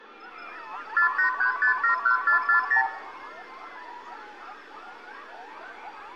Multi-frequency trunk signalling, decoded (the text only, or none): 483571440